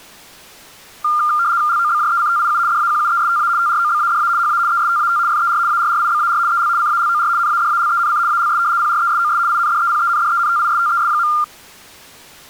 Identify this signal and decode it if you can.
RTTY (75 baud, 170 Hz shift), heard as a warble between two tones, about 1300 Hz centre. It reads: LOBJECTIU DAQUESTA TROBADA HA ESTAT FER ARRIBAR EL CALOR NADALENC ALS PRESOS INDEPENDENTISTES.